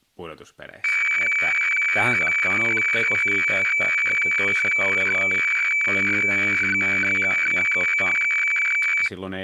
Weather fax (radiofax), 120 lines a minute, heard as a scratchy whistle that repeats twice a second, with speech in Finnish.